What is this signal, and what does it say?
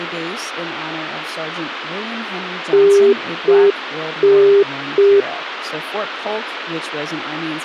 Telephone call progress tone (UK plan), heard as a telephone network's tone, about 400 Hz, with speech in English. Congestion tone.